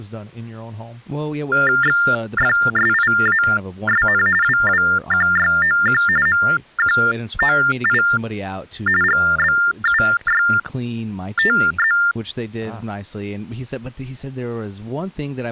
TTY/TDD text telephone tones (45.45 baud Baudot), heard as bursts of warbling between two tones, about 400 Hz shift, 1600 Hz centre, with speech in English. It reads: XFSIASN WWQYOQ MQOI GBUYTZ